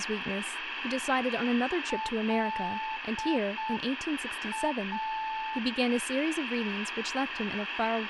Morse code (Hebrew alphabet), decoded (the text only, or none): לא